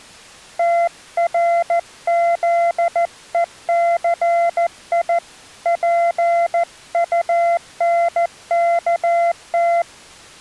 Morse code, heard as a keyed tone, hand-sent with a paddle, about 14 wpm, 680 Hz. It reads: TRZECI PUNKT